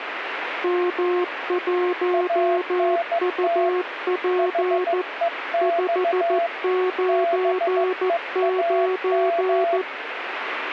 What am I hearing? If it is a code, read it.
Morse code, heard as two keyed tones, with radio static. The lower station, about 14 wpm, 360 Hz: M1UP 599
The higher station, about 15 wpm, 680 Hz: ANT HEX BEAM